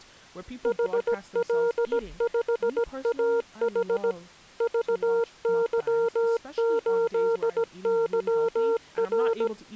Morse code, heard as a keyed tone, machine-sent, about 17 wpm, 460 Hz, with speech in English. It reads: HL5AH VY8YR